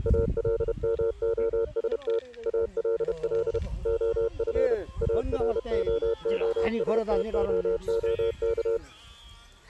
Morse code, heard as a keyed tone, machine-sent, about 31 wpm, 460 Hz, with the noise of a park. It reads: ALMOST ALL OF AROOSTOOK